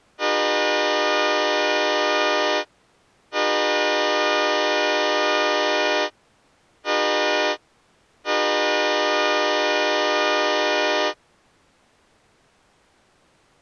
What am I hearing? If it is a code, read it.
Train horn signal, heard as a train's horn. 2 long, 1 short, 1 long. On North American railways: approaching a public crossing.